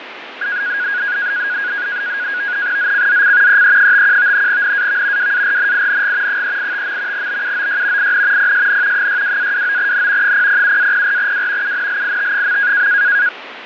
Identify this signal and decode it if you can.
NAVTEX (SITOR-B), 100 baud, 170 Hz shift, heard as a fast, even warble, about 1550 Hz centre, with radio static and fading. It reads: ZCZC EE51 NAV WARNING 385. BUOY IN PSN 62-29N 007-04W UNLIT.